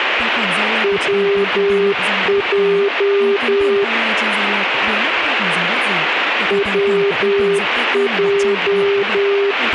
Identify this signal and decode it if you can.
Morse code, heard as a keyed tone, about 10 wpm, 400 Hz, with radio static and speech in Vietnamese. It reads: WJ WJ